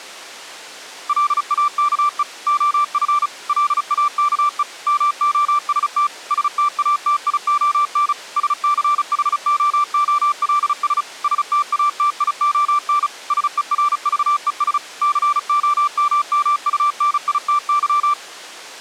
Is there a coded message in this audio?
Yes: Morse code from 1.0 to 18.2 s, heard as a keyed tone, machine-sent, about 35 wpm, 1170 Hz. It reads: LAKE OF LAKE MOST STATION SCHOOLS STATION SERVES COMMUNITY